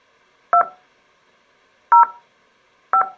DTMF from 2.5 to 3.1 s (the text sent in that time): 5